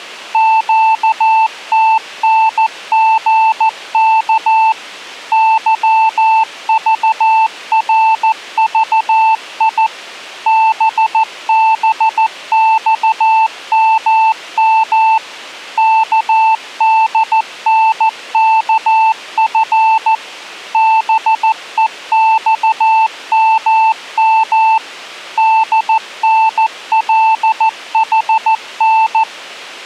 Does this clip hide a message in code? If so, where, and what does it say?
Yes: Morse code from 0.3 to 29.3 s, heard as a keyed tone, machine-sent, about 14 wpm, 890 Hz. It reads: QTNGK YVRVI BBXMM KDNKF BEXMM DNLHN